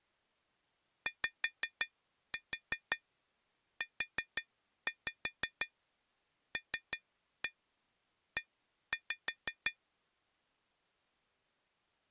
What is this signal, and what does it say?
Tap code, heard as taps on glass, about 5 knocks a second. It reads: YULE